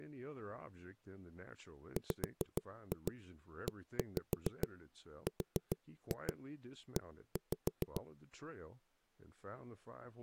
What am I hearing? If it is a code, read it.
Tap code, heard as knocks on a wall, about 6 knocks a second, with speech in English. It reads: WERE